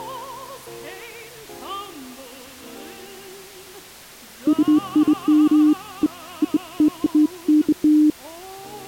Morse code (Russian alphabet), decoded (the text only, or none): none